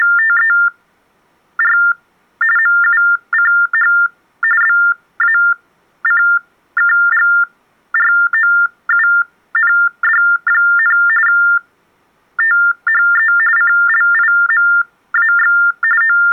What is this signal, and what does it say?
TTY/TDD text telephone tones (45.45 baud Baudot), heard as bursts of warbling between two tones, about 400 Hz shift, 1600 Hz centre. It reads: … MUCH BACKGROUND, THE CLIMAX …